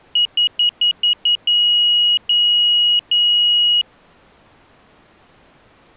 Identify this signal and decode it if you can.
Beep code, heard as a piezo beeper, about 2900 Hz. 6 short, 3 long.